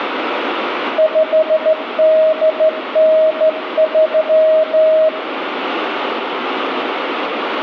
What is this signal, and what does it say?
Morse code (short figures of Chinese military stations), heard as a keyed tone, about 14 wpm, 630 Hz, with radio static and room echo. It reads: 5893